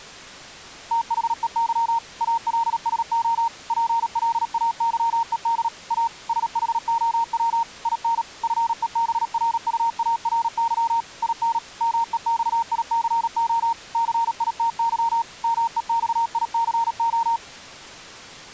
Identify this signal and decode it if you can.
Morse code, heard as a keyed tone, machine-sent, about 37 wpm, 920 Hz. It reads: THEY ALSO PLAYED A SHOW IN FEBRUARY IN MEXICO CITY MEXICO